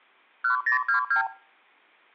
Multi-frequency trunk signalling (R2, with the far end's replies), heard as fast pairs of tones, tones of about 110 ms. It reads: 1022